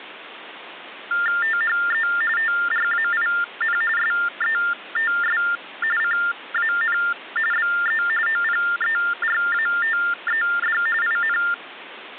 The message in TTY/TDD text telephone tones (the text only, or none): THE TRAIN SETS CAN BE OPERATED IN